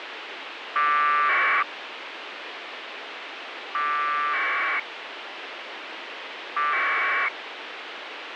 Packet radio (AX.25, as in APRS), 1200 baud, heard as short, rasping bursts, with radio hiss.